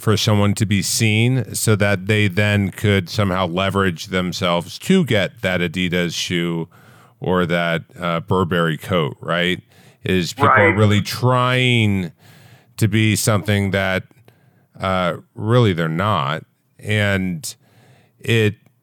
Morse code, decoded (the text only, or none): none